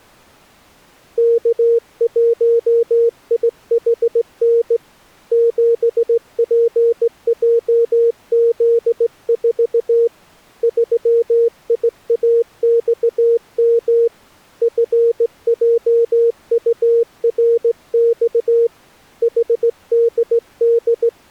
Morse code, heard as a keyed tone, hand-sent with a straight key, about 17 wpm, 470 Hz. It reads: K1IHN 7PJZ4 3IAXM FJURX …